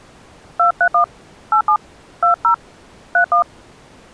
DTMF, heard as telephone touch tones, dialled by hand, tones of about 90 ms. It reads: 231 87 20 31